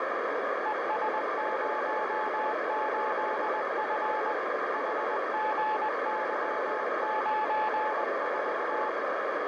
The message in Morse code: ES08F HGY94

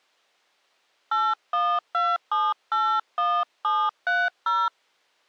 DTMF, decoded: 812781730

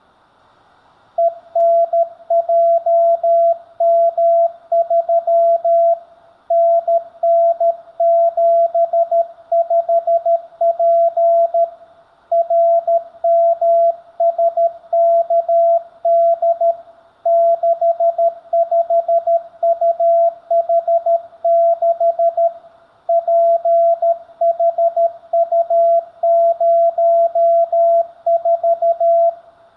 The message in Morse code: ENJM3 NN75P RMSKD 65UH6 PHU04

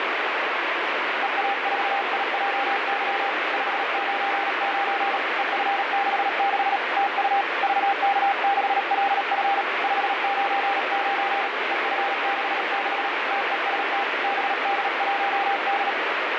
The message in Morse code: EA4IJY 599 EF66 TU VK6LF 599 EF66 TEST BD1D

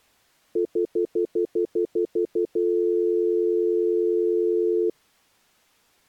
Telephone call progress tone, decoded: stutter dial tone

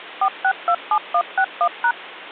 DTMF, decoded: 4627161#

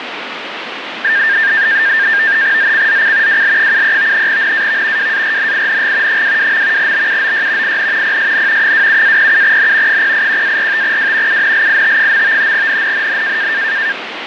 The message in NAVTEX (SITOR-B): ZCZC WL73 NAV WARNING 22. BUOY IN PSN 27-07N 081-45W UNLIT. NNNN

